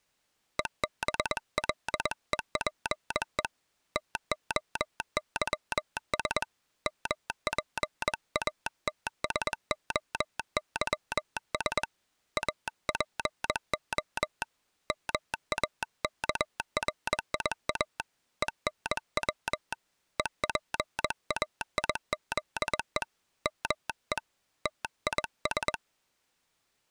Morse code (Greek alphabet), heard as a telegraph sounder, hand-sent with a paddle, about 21 wpm. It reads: ΕΒΛΕΠΕ ΤΟΥΣ ΜΠΑΤΣΟΥΣ ΑΠΟ ΜΑΚΡΙΑ ΕΝΩ ΕΠΑΙΖΕ ΜΕ ΤΙΣ